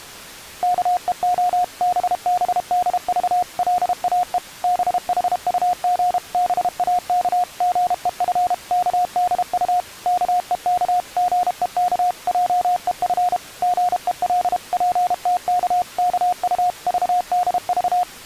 Morse code (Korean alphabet), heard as a keyed tone, machine-sent, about 32 wpm, 720 Hz. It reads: 앞뜰과 뒷동산의 앙상한 삭정이를